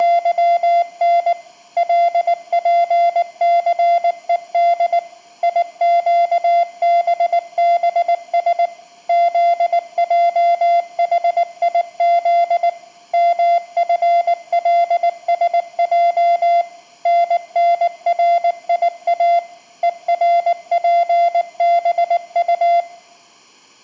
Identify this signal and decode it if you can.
Morse code, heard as a keyed tone, machine-sent, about 19 wpm, 690 Hz, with room echo. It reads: … LPCED IQBBS ZJHIZ MFLSJ NNRIA ERPBU